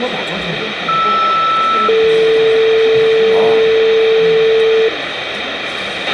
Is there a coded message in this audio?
Yes: two-tone page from 0.9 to 4.9 s, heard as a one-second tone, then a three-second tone, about 1320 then 450 Hz, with radio hiss, a squelch burst at the end, room echo and the noise of a crowd indoors.